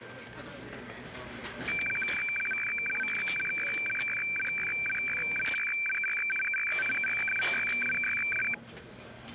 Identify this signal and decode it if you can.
Weather fax (radiofax), 120 lines a minute, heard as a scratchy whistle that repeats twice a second, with the noise of a restaurant.